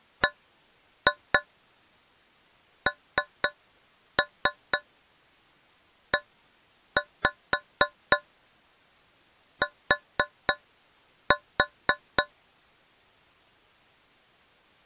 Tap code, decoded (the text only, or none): BNET